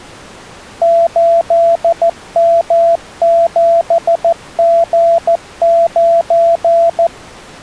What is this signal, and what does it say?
Morse code, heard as a keyed tone, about 14 wpm, 670 Hz. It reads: 8M7G9